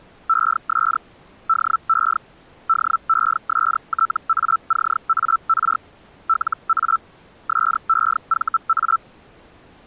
Hellschreiber (Feld-Hell, 122.5 baud), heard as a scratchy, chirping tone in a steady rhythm, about 1330 Hz. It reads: ES DE DESTACAR LA SEVA